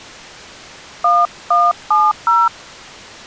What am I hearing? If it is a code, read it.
DTMF, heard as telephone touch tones, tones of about 210 ms. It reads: 1170